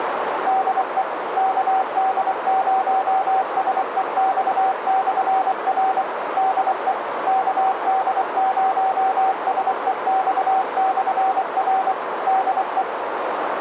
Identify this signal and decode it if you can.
Morse code, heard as a keyed tone, machine-sent, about 24 wpm, 760 Hz, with radio static and a narrow filter. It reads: DE KD0SEX/R DE KD0SEX/R DE